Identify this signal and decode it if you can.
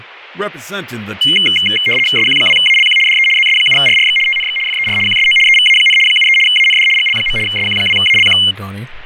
RTTY (75 baud, 850 Hz shift), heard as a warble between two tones, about 2550 Hz centre, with radio static and speech in English. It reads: SQ2ALQ DE ZS7RRX TNX FER QSO EVA, 73 AND GL. SQ2ALQ